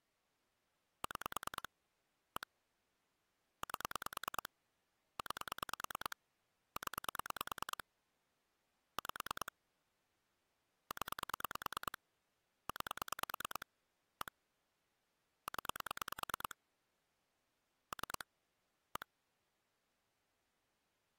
Pulse dialling, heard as clicks on a phone line, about 9 pulses a second. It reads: 6 1 8 9 0 5 0 9 1 0 3 1